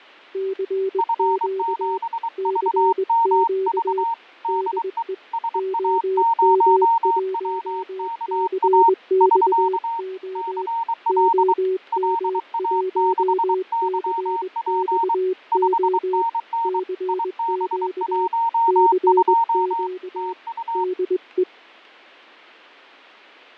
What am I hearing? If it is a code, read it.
Morse code, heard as two keyed tones, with fading. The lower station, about 21 wpm, 380 Hz: CQ CQ DE OM1CXO OM1CXO CQ CQ DE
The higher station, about 23 wpm, 920 Hz: F7VMV DE SA0WKA <SK> CL LA6YP 5NN IB12 TU